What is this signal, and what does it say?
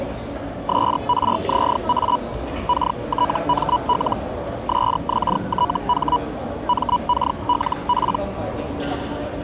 Hellschreiber (Feld-Hell, 122.5 baud), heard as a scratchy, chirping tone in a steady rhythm, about 980 Hz, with the noise of a crowd indoors. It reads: SRZA KTML SXTH MKLP